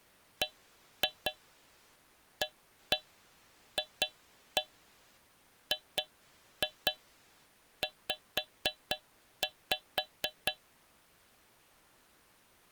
Tap code, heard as taps on a metal pipe, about 4 knocks a second. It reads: BAFGZ